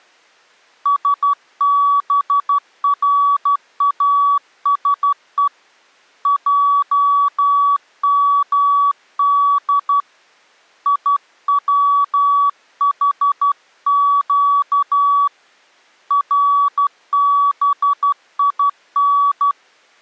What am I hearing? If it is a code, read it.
Morse code (Hebrew alphabet), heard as a keyed tone, hand-sent with a straight key, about 12 wpm, 1140 Hz. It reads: שבראשו עמד יצחק רבין